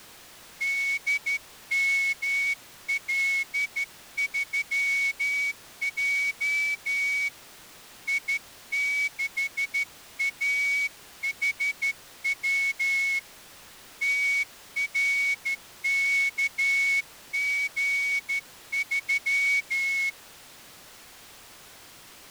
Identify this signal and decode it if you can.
Morse code, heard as a whistle, hand-sent with a straight key, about 13 wpm. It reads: DML3J I6AHW TRKG3